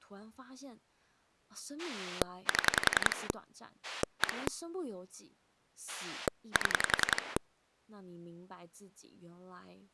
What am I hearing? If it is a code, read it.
Pulse dialling, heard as a rotary dial, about 10 pulses a second, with speech in Chinese. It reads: 7 1 7